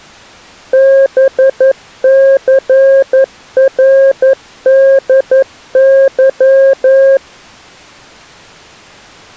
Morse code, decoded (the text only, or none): BCRDY